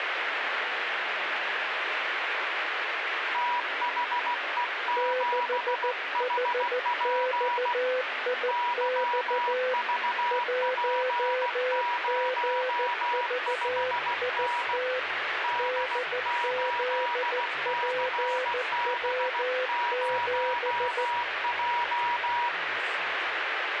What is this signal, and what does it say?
Morse code, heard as two keyed tones, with radio static. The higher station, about 16 wpm, 970 Hz: THE7HP YVP05N D8CB0J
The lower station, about 14 wpm, 510 Hz: 6HXIX 1GVIT DZPW7